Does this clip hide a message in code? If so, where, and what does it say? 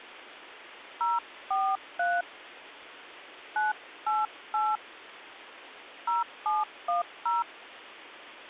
Yes: DTMF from 1.0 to 7.4 s, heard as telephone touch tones, dialled by hand, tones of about 200 ms. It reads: 043 988 0710